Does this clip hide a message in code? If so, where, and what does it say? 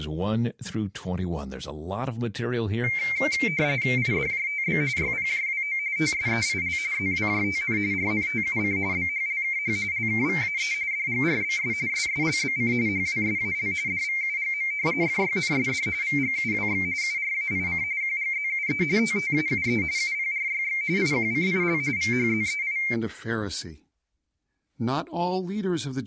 Yes: RTTY (45.45 baud, 170 Hz shift) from 2.8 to 22.9 s, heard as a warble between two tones, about 2200 Hz centre, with speech in English. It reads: IDJTB YPJWO TSEIL ZWJTN RNTUC BHLKH LKVAE DGRBS SSLBC HWSAL DVUGM FYNSD VGUWX URAIC QGZUE TTAUE UPRYX IQCIL VHZEI